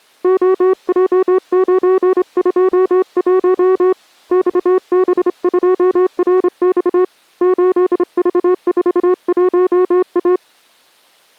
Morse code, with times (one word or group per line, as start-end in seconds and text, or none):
0.2-3.9 OJ921
4.3-7.0 XB2RX
7.4-10.4 8V41A